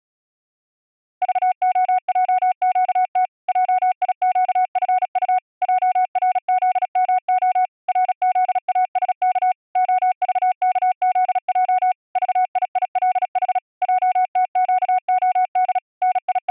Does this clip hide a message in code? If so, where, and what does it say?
Yes: Morse code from 1.2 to 16.5 s, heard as a keyed tone, machine-sent, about 36 wpm, 740 Hz. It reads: VOJQT JIQFU JRZMO RZASK OVKZJ VIILH JTQOD …